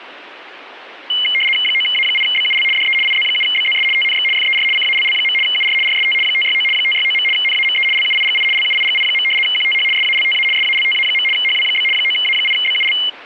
RTTY (75 baud, 850 Hz shift), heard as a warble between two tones, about 2550 Hz centre. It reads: 9A8BUL DE IZ7BZS TNX FER CALL. UR RST 569 569. NAME LUIGI LUIGI. QTH SALTA SALTA. HW? 9A8BUL